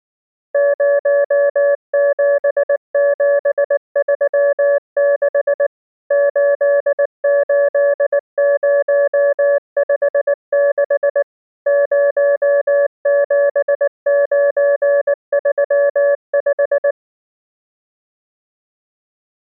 Morse code, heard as a keyed tone, machine-sent, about 19 wpm, 570 Hz. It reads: 07736 88056 07935